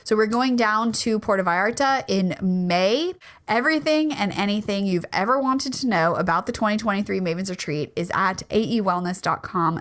Speech in English. There is no code.